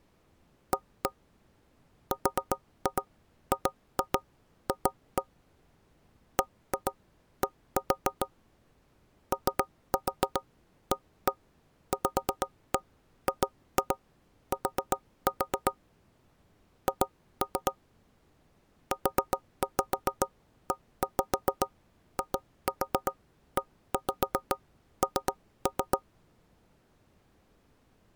Tap code, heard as knocks on wood, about 7 knocks a second. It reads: A RGF BD OAVGT H UEIEN